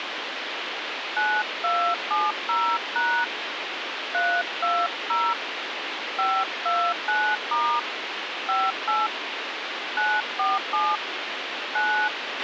DTMF, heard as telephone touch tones, dialled by hand, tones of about 250 ms, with radio hiss and a squelch burst at the end. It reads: 9270# 320 529* 58 947 9